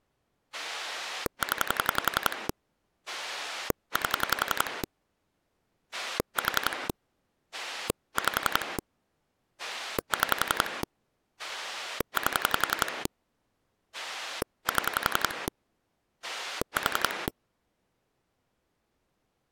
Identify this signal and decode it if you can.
Pulse dialling, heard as a rotary dial, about 11 pulses a second. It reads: 0 8 4 5 6 8 7 4